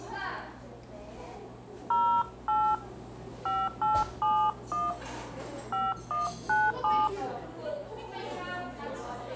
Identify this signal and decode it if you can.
DTMF, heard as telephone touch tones, dialled by hand, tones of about 240 ms, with room echo and the noise of a cafe. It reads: 08 5871 5197